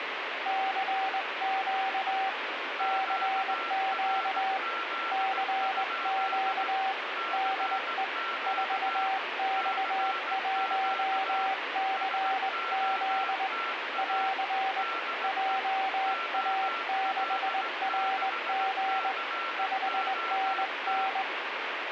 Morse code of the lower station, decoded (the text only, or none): CQ CQ CQ DE 4X1CZ <AR> JA6RG 5NN